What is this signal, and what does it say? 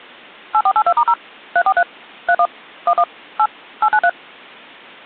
DTMF, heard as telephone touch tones, dialled by machine, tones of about 60 ms. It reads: 8482*0 343 31 11 8 893